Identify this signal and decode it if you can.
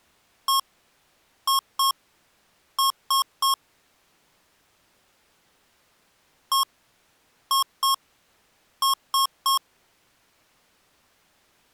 Beep code, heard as beeps from a small speaker, played twice, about 1080 Hz. 1-2-3. In Phoenix BIOS tables: DMA page register failure.